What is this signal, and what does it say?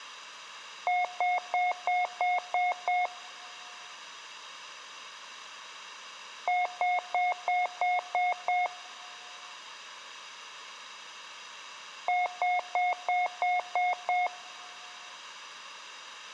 Beep code, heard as beeps, played three times, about 720 Hz, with room echo. 7 short. In AMI BIOS tables: virtual mode exception error; in Dell tables: processor failure.